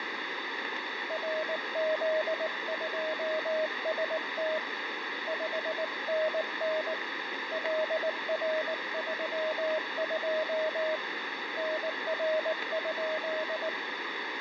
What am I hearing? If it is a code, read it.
Morse code, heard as a keyed tone, hand-sent with a paddle, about 19 wpm, 630 Hz, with radio static. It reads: RZ2ST 5NN LR32 NR?